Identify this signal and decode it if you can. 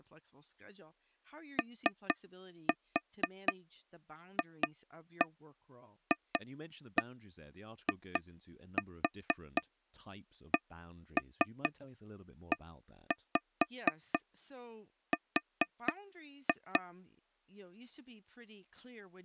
Tap code, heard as taps on a table, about 4 knocks a second, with speech in English. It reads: OFFICER